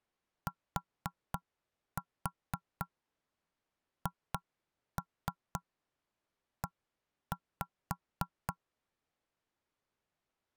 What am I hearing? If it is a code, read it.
Tap code, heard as knocks on wood, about 3 knocks a second. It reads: THE